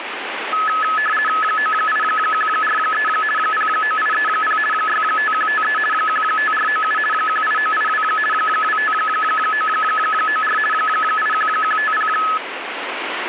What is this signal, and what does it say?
RTTY (50 baud, 450 Hz shift), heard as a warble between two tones, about 1500 Hz centre, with radio static. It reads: 98143 09830 65153 15497 18982 25994 81150